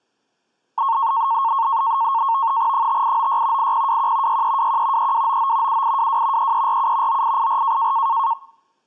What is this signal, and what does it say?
NAVTEX (SITOR-B), 100 baud, 170 Hz shift, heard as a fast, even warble, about 1000 Hz centre. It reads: 5896 8021 6321 3299 7822 3347 9884